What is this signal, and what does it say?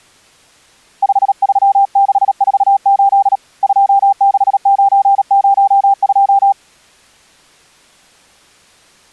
Morse code, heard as a keyed tone, hand-sent with a paddle, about 37 wpm, 790 Hz. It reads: 53648 26902